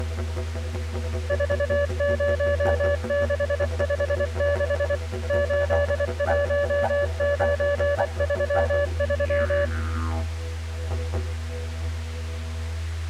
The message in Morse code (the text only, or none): 40656 81933